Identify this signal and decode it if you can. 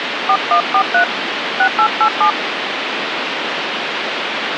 DTMF, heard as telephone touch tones, dialled by hand, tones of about 80 ms, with phone line noise. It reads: 4143 6887